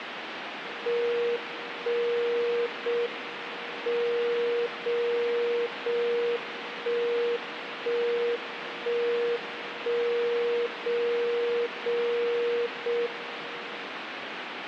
Radio time signal (JJY), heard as a tone whose level steps once a second, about 470 Hz, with radio static. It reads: 1 0 M 0 0 1 1 1 1 0 0 0 M